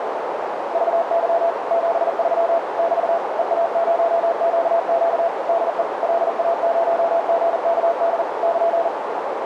Morse code, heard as a keyed tone, machine-sent, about 40 wpm, 670 Hz, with heavy radio static and a narrow filter. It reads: VY 73 <BT> EA0QQ DE LA0GKD <KN>